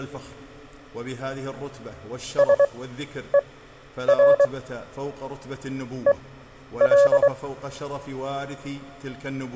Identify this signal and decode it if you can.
Morse code, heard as a keyed tone, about 23 wpm, spaced as for 10 wpm, 560 Hz. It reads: SER EL